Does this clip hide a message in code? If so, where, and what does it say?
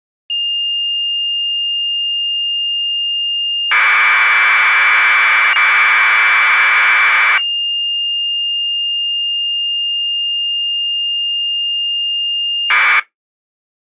Yes: Commodore tape loading (standard loader) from 0.3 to 13.0 s, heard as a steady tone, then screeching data.